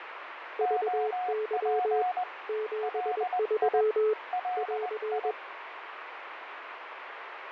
Morse code, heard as two keyed tones, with radio static and fading. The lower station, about 21 wpm, 430 Hz: VY 73 <AR>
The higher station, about 20 wpm, 730 Hz: OP LI LI